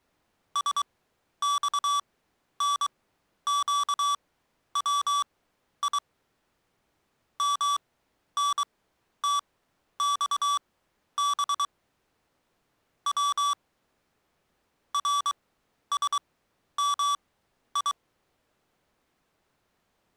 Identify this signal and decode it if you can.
Morse code (Persian alphabet), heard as electronic beeps, machine-sent, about 23 wpm, spaced as for 11 wpm, 1150 Hz. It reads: سخنگوی منتخب و رسمی